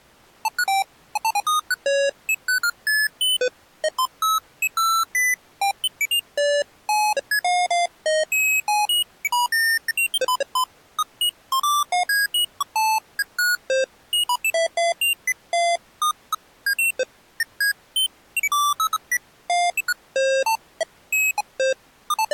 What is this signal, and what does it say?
Electronic bleeps of random pitch and length. There is no code.